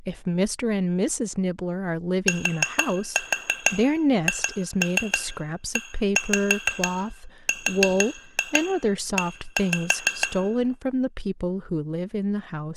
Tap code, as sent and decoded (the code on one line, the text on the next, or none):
4-4 2-3 1-5 4-2 1-5
THERE